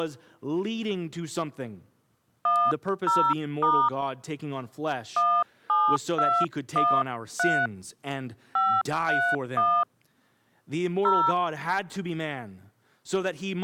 DTMF, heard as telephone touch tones, dialled by hand, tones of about 260 ms. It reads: 10* 17213 531 0